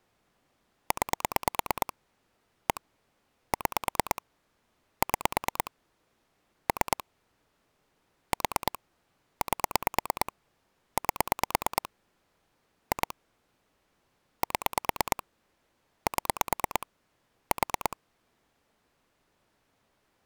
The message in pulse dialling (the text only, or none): 9 1 6 6 3 4 8 8 2 7 7 4